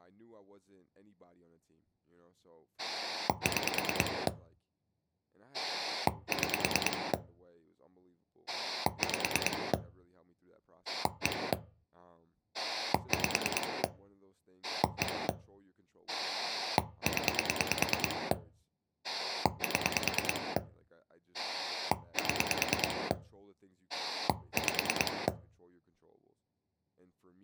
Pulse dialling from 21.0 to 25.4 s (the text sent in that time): 7 5